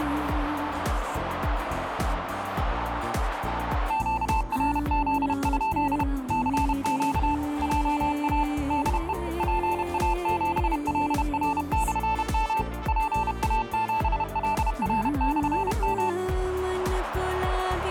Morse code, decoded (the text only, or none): QRZ? CQ JA DE PA7LR/M PA7LR/M